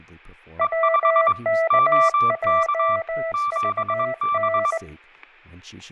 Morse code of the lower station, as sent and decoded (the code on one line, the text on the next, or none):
.-- -.- .--- ...- -.
WKJVN